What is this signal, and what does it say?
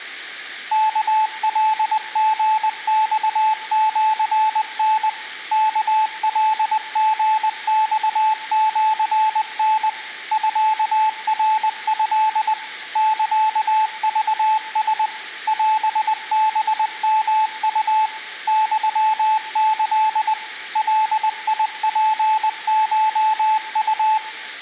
Morse code (Japanese Wabun code), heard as a keyed tone, machine-sent, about 20 wpm, 870 Hz, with room echo. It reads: ワカリマシタ ワカリマシタ ミナト サクラ オハヨウ ユキ ガツコウ